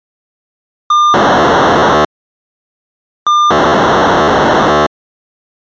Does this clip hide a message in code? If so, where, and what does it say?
Yes: POCSAG pager data (2400 baud) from 0.9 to 4.9 s, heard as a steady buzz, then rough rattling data.